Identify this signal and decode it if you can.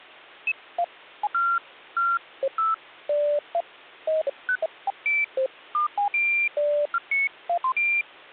Electronic bleeps of random pitch and length, with hum. There is no code.